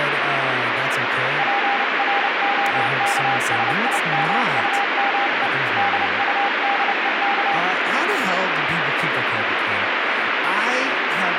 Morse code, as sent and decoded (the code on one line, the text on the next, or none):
.--. .-. --- -.- ... .. -- ..- -- . / -.. ..- -.. . -.-
PROKSIMUME DUDEK